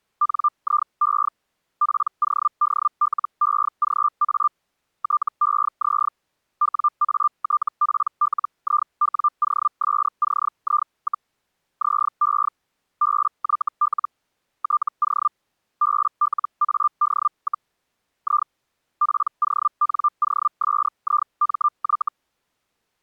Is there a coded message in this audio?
Yes: Hellschreiber (Feld-Hell, 122.5 baud) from 0.2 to 22.1 s, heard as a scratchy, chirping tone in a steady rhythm, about 1190 Hz. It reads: NIE PODLEGA TEZ WATPLIWOSCI, ZE BYL TO BLAD, I PONOSIMY